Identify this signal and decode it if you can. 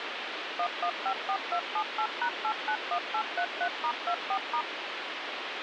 DTMF, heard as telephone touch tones, dialled by machine, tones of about 80 ms, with phone line noise. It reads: 1154278#891833*24*